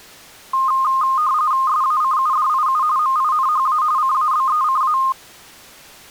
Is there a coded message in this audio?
Yes: RTTY (45.45 baud, 170 Hz shift) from 0.5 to 5.1 s, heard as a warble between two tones, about 1140 Hz centre. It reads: SACUDIU MINHA CABECA